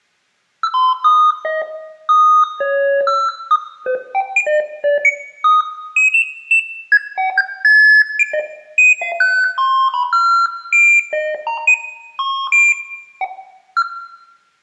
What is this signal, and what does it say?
Electronic bleeps of random pitch and length, with room echo. There is no code.